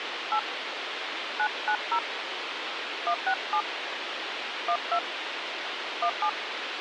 DTMF, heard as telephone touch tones, dialled by hand, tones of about 70 ms, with radio hiss. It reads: 8 990 167 12 17